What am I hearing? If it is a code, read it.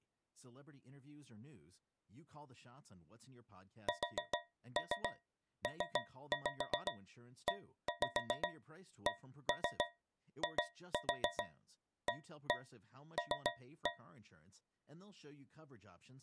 Tap code, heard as taps on a metal pipe, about 7 knocks a second, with speech in English. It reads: SPECIAL